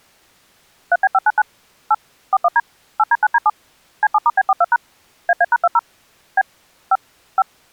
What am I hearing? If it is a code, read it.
DTMF, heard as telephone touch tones, dialled by machine, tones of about 40 ms. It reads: 3B599 8 41D 8D9D7 C7*B42# AA#20 B 5 5